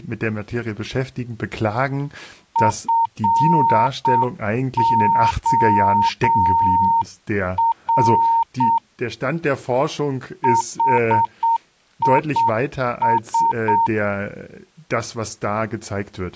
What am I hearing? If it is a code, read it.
Morse code, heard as a keyed tone, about 7 wpm, 920 Hz, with speech in German. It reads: FOR HIS